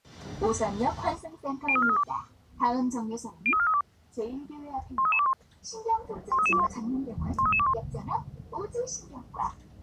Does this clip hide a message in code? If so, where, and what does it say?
Yes: five-tone selective call (ZVEI) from 1.7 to 7.7 s, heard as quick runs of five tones, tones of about 70 ms, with the noise inside a bus. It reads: 03432 03432 13321 13321 13321